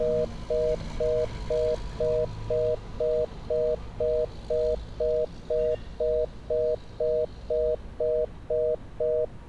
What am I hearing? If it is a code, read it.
Telephone call progress tone (North American plan), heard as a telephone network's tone, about 480, 620 Hz, 0.25 s on and 0.25 s off, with street noise. Congestion tone.